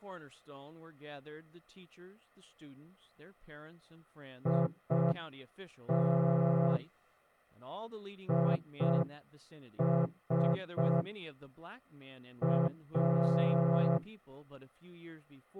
Morse code, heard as a horn, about 5 wpm, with speech in English. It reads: IT IS A